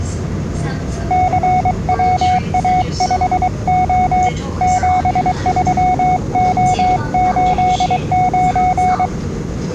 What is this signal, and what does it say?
Morse code, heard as a keyed tone, hand-sent with a paddle, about 23 wpm, 740 Hz, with the noise inside a subway train. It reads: CWA5O 73O89